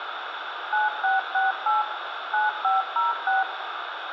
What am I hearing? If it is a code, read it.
DTMF, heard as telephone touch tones, dialled by machine, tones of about 160 ms, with radio hiss and room echo. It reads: 9668 9506